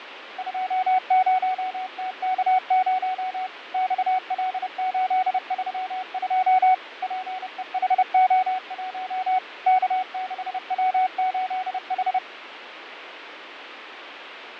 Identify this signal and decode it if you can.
Morse code, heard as a keyed tone, machine-sent, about 30 wpm, 750 Hz, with radio static and fading. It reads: 20TK0 XL832 PEHO1 K6W8H